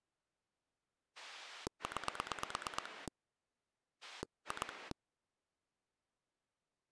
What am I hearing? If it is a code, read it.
Pulse dialling, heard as a rotary dial, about 9 pulses a second. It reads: 9 2